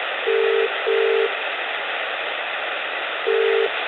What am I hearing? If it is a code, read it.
Telephone call progress tone (as in the UK, Ireland, Australia and similar networks), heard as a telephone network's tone, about 400, 450 Hz, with phone line noise and room echo. Ringback tone.